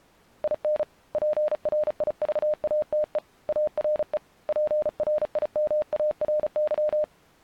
Morse code, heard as a keyed tone, hand-sent with a paddle, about 35 wpm, 610 Hz. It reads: IN PRIVATE ARE PRIMARY